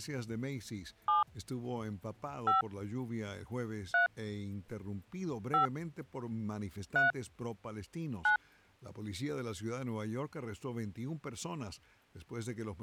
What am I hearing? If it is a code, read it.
DTMF, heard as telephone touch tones, dialled by hand, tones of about 120 ms. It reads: 7 5 3 5 3 9